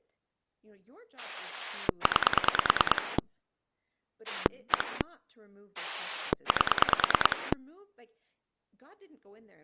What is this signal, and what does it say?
Pulse dialling, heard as a rotary dial, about 9 pulses a second, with speech in English. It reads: 9 1 8